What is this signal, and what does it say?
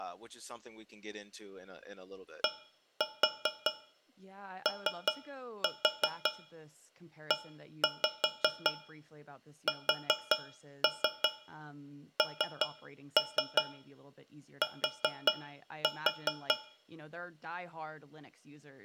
Tap code, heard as taps on a metal pipe, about 5 knocks a second, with room echo and speech in English. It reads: DOESNT